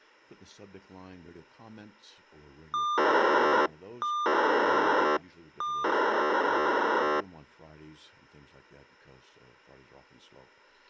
POCSAG pager data (2400 baud), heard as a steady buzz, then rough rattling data.